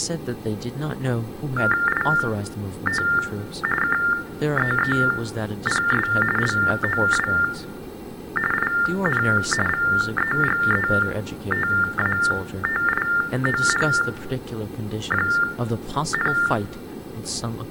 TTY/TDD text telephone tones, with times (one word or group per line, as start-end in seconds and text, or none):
1.9-3.0 IT
3.8-6.1 KEEPS
6.4-7.3 LOW
8.5-9.2 IN
9.7-16.3 VEGETATION,